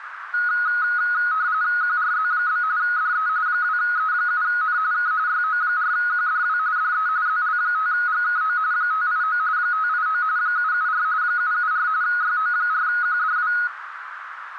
RTTY (45.45 baud, 170 Hz shift), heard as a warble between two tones, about 1360 Hz centre, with radio static and a narrow filter. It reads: QRZ? DE 2E7N K YO4QDW DE ZL5GKO 589 589 774 774 YO4QDW